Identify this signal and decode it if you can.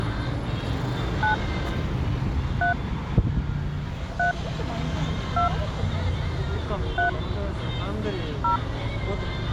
DTMF, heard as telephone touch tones, dialled by hand, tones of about 120 ms, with street noise. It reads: 9 3 3 2 3 0